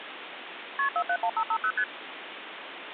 Multi-frequency trunk signalling (R1, as on North American trunks), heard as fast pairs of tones, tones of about 70 ms, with phone line noise. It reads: KP 471550 ST